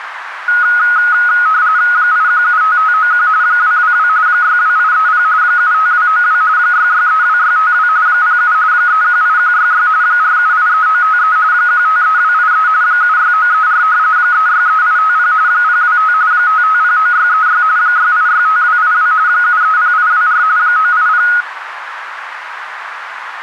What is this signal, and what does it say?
RTTY (45.45 baud, 170 Hz shift), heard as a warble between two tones, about 1360 Hz centre, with radio static and a narrow filter. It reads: 8175591 222 62830 75292 6632652 07 318166 4783953 153283 76934 363850 025 5509636 6865282 730824 980